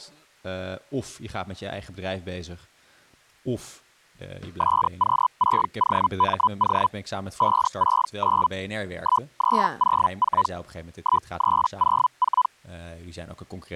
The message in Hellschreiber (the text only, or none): SQ6OMO 569 1304 1304